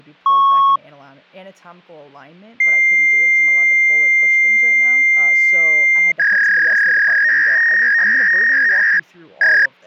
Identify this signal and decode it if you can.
Fax machine handshake, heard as a beep, a long tone and a warble, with speech in English.